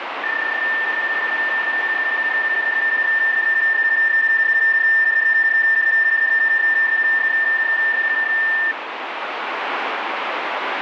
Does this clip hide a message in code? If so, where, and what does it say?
Yes: PSK31 (31.25 baud) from 0.2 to 8.7 s, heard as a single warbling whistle, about 1800 Hz, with radio static.